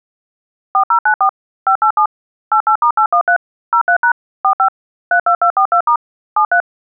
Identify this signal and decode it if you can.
DTMF, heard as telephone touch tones, dialled by machine, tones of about 90 ms. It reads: 4094 587 88*813 03# 45 32242* 73